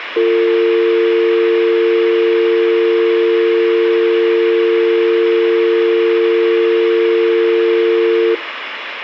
Telephone call progress tone (North American or UK plan), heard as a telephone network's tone, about 350, 450 Hz, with phone line noise. Dial tone.